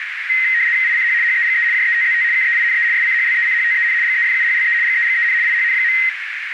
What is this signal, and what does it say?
RTTY (75 baud, 170 Hz shift), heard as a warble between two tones, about 1950 Hz centre, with radio static and a narrow filter. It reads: ICH HEGE JETZT KEINE SCHLECHTEN GEFUHLE GEGEN IHN.